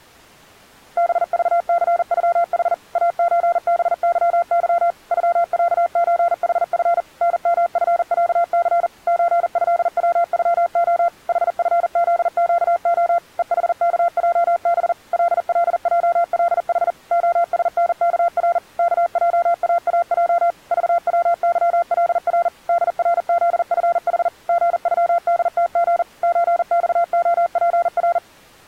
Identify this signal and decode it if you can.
Morse code (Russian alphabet), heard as a keyed tone, machine-sent, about 40 wpm, 690 Hz. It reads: БЖЦЮХ АЧБЫЫ ЮЯЧХФ НМФЯЦ ЧЭВЮО ХФЗЩО ЕХКЙБ ЛЛЙЛХ ОСНКР КЙААЙ ЖВЫЛР ДРЗФХ ГЮДТГ ЧЬОПР